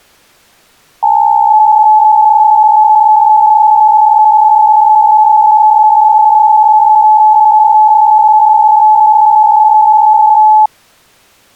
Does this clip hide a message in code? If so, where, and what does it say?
Yes: PSK63 (62.5 baud) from 1.0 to 10.7 s, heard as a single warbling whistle, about 860 Hz.